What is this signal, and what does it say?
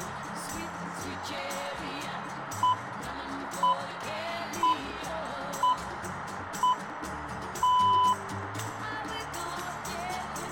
Radio time signal (six pips, as the Greenwich Time Signal), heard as pips, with radio static.